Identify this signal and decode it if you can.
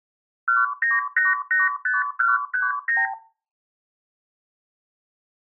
Multi-frequency trunk signalling (R2, with the far end's replies), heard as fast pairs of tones, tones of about 170 ms. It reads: 19885139